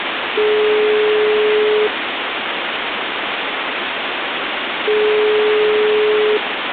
Telephone call progress tone (single-tone plan, as in most of Europe), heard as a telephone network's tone, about 420 Hz, 1.5 s on and 3 s off, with phone line noise. Ringback tone.